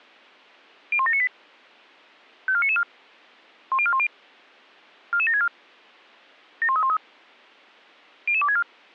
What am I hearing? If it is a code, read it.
Five-tone selective call (ZVEI), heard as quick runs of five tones, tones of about 70 ms. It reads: 01798 54994 10410 44764 71313 00264